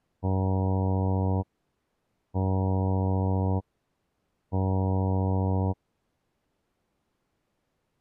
Ship horn signal, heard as a ship's horn, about 100 Hz. 3 short. At sea: I am operating astern propulsion.